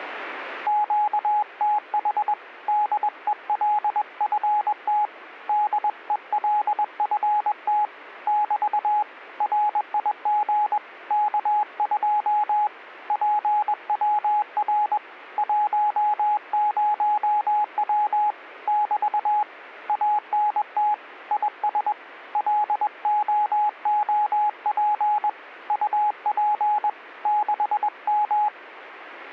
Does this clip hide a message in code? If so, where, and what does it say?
Yes: Morse code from 0.6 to 28.5 s, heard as a keyed tone, hand-sent with a paddle, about 21 wpm, 840 Hz. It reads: QTH DELFT DELFT <BT> RIG K2 PWR 10W <BT> ANT IS LOOP UP 6M